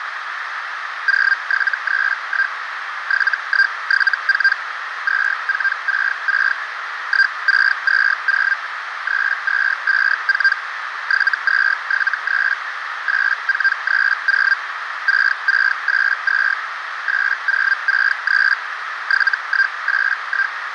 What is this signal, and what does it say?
Hellschreiber (Feld-Hell, 122.5 baud), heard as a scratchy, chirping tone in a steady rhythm, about 1600 Hz, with radio static and a narrow filter. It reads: 0731 7174 2466 1620 3254 7273 8430 6682 8063 7181